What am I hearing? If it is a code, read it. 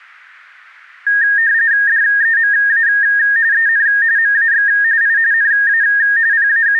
RTTY (45.45 baud, 170 Hz shift), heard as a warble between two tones, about 1750 Hz centre. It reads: DEMA EN MAX I NA …